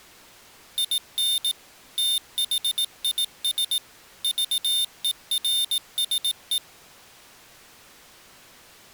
Morse code, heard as a high beeper, machine-sent, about 18 wpm, 3600 Hz. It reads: IN THIS VERSE